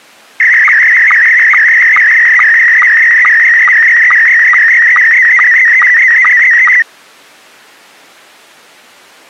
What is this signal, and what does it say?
SSTV (slow-scan television), Scottie S1, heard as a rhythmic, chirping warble.